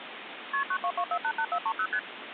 Multi-frequency trunk signalling (R1, as on North American trunks), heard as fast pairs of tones, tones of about 70 ms, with phone line noise. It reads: KP 922488430 ST